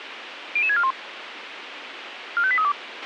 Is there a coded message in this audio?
Yes: five-tone selective call (ZVEI) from 0.6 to 2.7 s, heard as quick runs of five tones, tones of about 70 ms, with radio hiss and a squelch burst at the end. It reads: 00641 45832